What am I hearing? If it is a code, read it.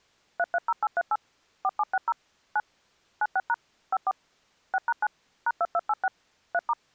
DTMF, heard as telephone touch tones, dialled by machine, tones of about 40 ms. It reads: 330838 4760 9 96# 54 6#9 #2286 3*